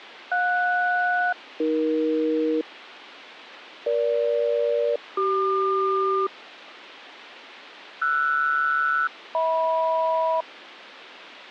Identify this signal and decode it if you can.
Aircraft SELCAL, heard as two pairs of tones. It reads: JS-AE EG-CQ RS-HM